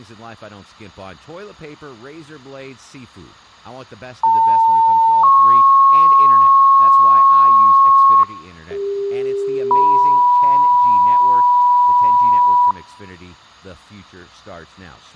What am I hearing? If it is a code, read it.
Two-tone page, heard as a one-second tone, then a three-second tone, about 900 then 1090 Hz, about 400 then 980 Hz, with speech in English.